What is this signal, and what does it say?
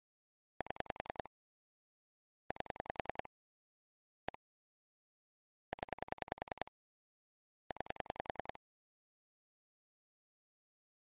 Pulse dialling, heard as clicks on a phone line, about 10 pulses a second. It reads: 7 8 1 0 9